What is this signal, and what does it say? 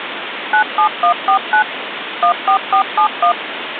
DTMF, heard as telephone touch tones, dialled by machine, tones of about 90 ms, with phone line noise. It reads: 97149 14471